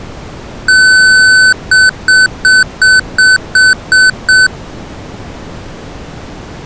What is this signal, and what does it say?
Beep code, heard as beeps from a small speaker, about 1500 Hz. 1 long, 8 short. In AMI BIOS tables: display or retrace test failure.